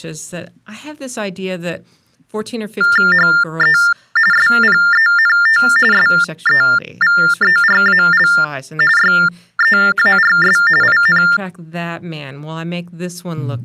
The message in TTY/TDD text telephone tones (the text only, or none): HE SPENT SEVERAL YEARS IN